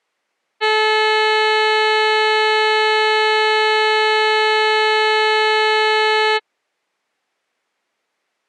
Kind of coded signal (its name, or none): ship horn signal